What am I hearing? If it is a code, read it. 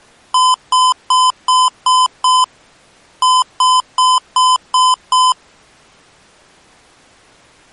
Beep code, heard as beeps from a small speaker, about 1020 Hz. 6-6.